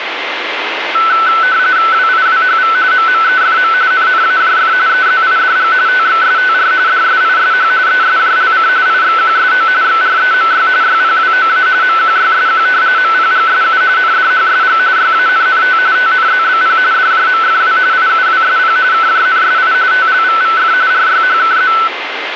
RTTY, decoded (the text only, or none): WIWHV MMEFM NNAJF EZIDG TXSTR DSISH ESJLC IXQSO XREMY YPWOA MQYSQ MPGSU NDHSG YANNT TNZBP DJMFW IUWSP KJNSI TLVVF RYHKZ